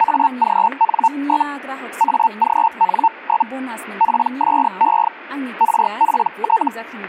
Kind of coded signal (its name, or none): Hellschreiber